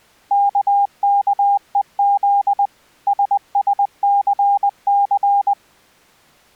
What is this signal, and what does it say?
Morse code, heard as a keyed tone, machine-sent, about 20 wpm, 800 Hz. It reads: KKEZ SSCC